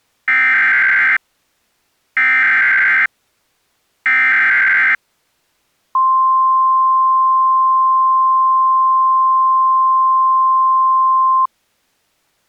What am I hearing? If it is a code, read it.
Emergency Alert System (SAME) tones (header bursts, then the 1050 Hz attention tone), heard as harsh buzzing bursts, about 520.83 baud.